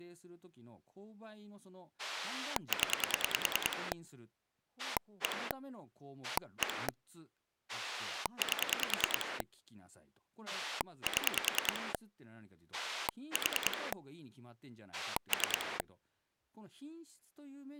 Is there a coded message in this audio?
Yes: pulse dialling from 2.0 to 15.8 s, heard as a rotary dial, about 10 pulses a second, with speech in Japanese. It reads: 0 1 1 8 7 4 3